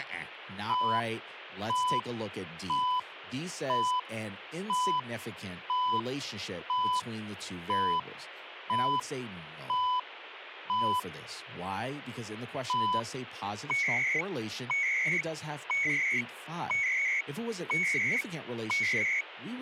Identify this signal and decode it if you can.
Radio time signal (CHU, Canada), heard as beeps and data bursts, one a second, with radio static and speech in English.